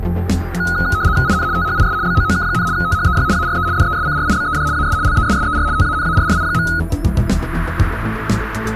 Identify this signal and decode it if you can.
RTTY (75 baud, 170 Hz shift), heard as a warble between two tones, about 1360 Hz centre. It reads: IN THIS BOOK, THEY ARE DESCRIBED AS LESSER TANARRI.